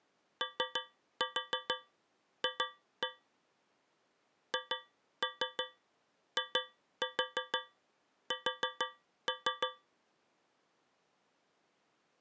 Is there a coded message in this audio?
Yes: tap code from 0.4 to 9.9 s, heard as taps on a metal pipe, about 6 knocks a second. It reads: OF HIS